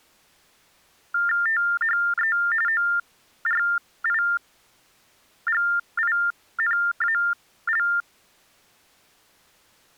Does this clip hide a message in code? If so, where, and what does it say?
Yes: TTY/TDD text telephone tones (45.45 baud Baudot) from 1.1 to 8.0 s, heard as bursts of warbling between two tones, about 400 Hz shift, 1600 Hz centre. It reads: THE ORIGINAL